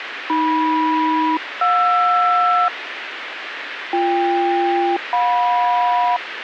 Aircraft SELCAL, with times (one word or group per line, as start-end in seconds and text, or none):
0.3-2.7 AM-JR
3.9-6.2 BK-JM